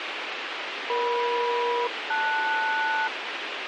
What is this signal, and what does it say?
Aircraft SELCAL, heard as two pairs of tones, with radio hiss and a squelch burst at the end. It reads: EM-LS